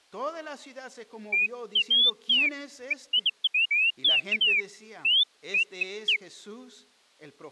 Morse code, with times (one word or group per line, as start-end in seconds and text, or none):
none